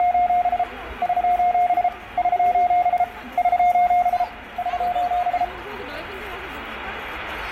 Morse code, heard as a keyed tone, hand-sent with a paddle, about 33 wpm, 710 Hz, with room echo and the noise of a park. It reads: … <SOS> <SOS> <SOS> <SOS>